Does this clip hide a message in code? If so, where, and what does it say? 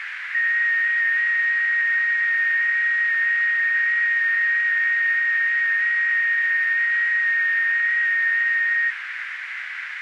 Yes: FT8 (one signal) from 0.3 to 8.9 s, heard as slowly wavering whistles, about 6.25 baud, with radio static and a narrow filter.